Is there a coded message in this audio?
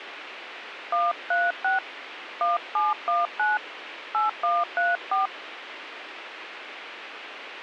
Yes: DTMF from 0.9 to 5.3 s, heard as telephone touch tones, dialled by hand, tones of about 180 ms, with radio hiss. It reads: 136 1719 8134